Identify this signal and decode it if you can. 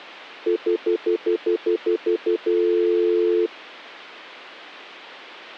Telephone call progress tone (North American plan), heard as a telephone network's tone, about 350, 440 Hz, 0.1 s on and 0.1 s off. Stutter dial tone.